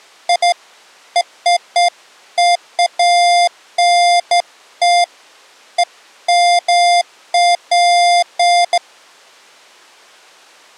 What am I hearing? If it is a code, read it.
Beeps of irregular length. There is no code.